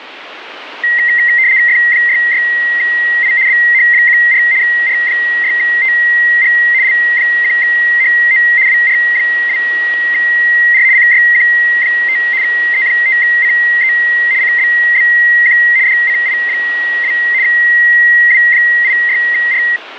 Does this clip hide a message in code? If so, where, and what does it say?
Yes: RTTY (75 baud, 170 Hz shift) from 0.8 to 19.8 s, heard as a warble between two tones, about 2000 Hz centre, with radio static. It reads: F66I BH14 R6TG L1HO WR2R CYQ5 E5CE CBBQ DCI2 W86R